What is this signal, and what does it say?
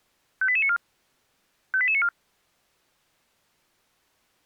Five-tone selective call (ZVEI), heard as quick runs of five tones, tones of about 70 ms. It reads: 58894 58894